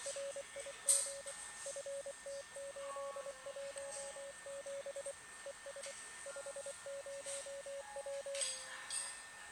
Morse code, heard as a keyed tone, machine-sent, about 24 wpm, 560 Hz, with radio static, a steady whistle near 1810 Hz and the noise of a cafe. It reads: RIG FT817 ES 50W